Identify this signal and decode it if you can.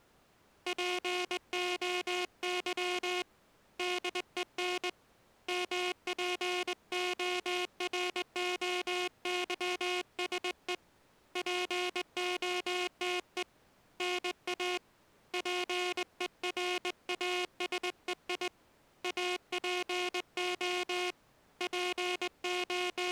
Morse code (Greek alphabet), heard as a buzzer, hand-sent with a straight key, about 20 wpm. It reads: ΠΟΥ ΔΕΝ ΜΠΟΡΟΥΣΕ ΠΟΤΕ ΝΑ ΠΕΡΑΣΕΙ ΑΠΟ …